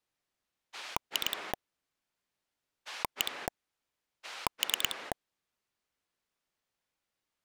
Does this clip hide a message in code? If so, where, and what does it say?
Yes: pulse dialling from 0.7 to 5.1 s, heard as a rotary dial, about 9 pulses a second. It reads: 2 1 3